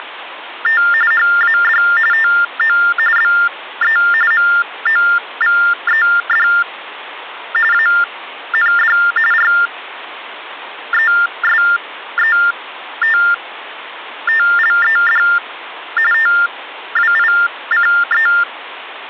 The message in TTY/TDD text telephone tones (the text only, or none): … HAD TO BE MOVED AND RESETTLED TWICE